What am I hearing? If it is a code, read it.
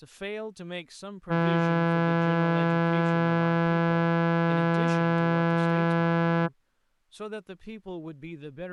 Ship horn signal, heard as a ship's horn, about 170 Hz, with speech in English. 1 long. At sea: a vessel nearing a blind bend, or under power and making way in fog.